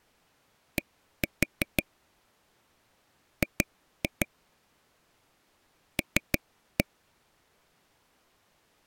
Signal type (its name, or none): tap code